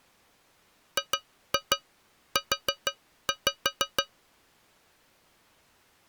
Tap code, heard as taps on a metal pipe, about 6 knocks a second. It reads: GU